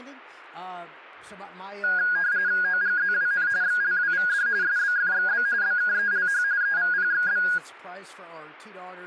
RTTY (45.45 baud, 170 Hz shift), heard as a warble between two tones, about 1550 Hz centre. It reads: OGZWN XLWVD SBFXB BKELH EVPXB